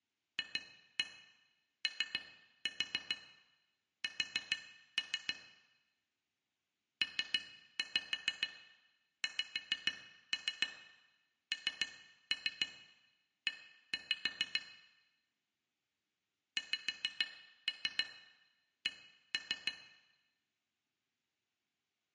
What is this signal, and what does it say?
Tap code, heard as taps on glass, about 6 knocks a second, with room echo. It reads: FOS PXNE XC